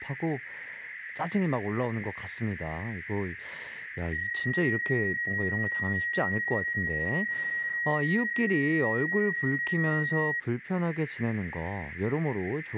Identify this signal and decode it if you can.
PSK31 (31.25 baud), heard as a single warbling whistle, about 1900 Hz, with radio static and speech in Korean.